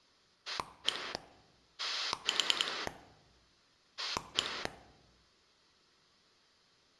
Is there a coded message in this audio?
Yes: pulse dialling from 0.5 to 4.7 s, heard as a rotary dial, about 10 pulses a second. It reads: 1 4 1